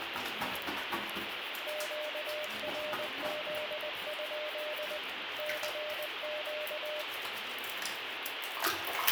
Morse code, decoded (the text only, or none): QRZ? CQ